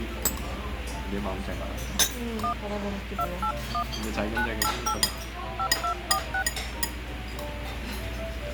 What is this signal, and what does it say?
DTMF, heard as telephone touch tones, dialled by hand, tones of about 80 ms, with radio hiss and the noise of a restaurant. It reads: 1 281 988 5246